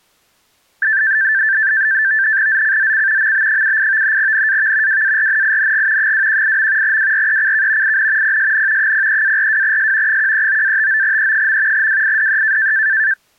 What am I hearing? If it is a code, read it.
NAVTEX (SITOR-B), 100 baud, 170 Hz shift, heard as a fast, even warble, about 1650 Hz centre. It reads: ZCZC MB78 NAV WARNING 218. WRECK IN PSN 03-42S 139-59E. WIDE